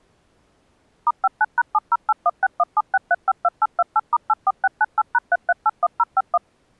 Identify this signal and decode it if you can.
DTMF, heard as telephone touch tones, dialled by machine, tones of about 40 ms. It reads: *59#70816176352828*84698#3381051